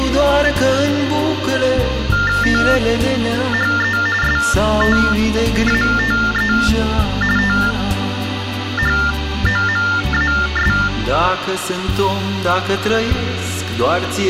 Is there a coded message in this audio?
Yes: TTY/TDD text telephone tones (45.45 baud Baudot) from 2.1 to 10.9 s, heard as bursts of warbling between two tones, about 400 Hz shift, 1600 Hz centre, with phone line noise. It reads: THE STATE THOMAS